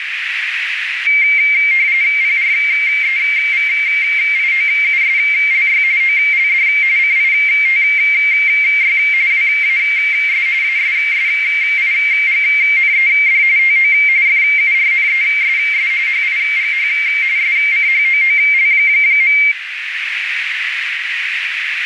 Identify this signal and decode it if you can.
RTTY (45.45 baud, 170 Hz shift), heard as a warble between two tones, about 2200 Hz centre, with radio static and a narrow filter. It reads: PREVIOUSLY OLD CITY WAS ASSIGNED TO FURNESS HIGH SCHOOL.